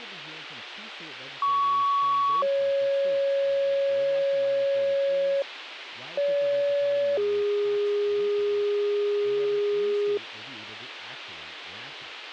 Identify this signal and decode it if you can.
Two-tone page, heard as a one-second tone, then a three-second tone, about 1120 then 550 Hz, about 570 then 410 Hz, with radio hiss and speech in English.